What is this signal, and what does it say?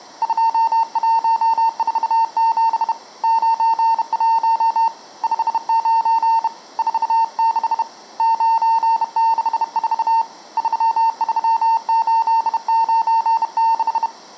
Morse code, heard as a keyed tone, hand-sent with a bug key, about 31 wpm, 910 Hz, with room echo. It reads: 2147 91 59 46 964 33896